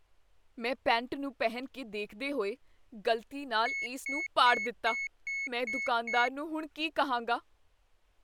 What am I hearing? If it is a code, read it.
Beep code, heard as a piezo beeper, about 2200 Hz, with speech in Punjabi. 7 short. In AMI BIOS tables: virtual mode exception error; in Dell tables: processor failure.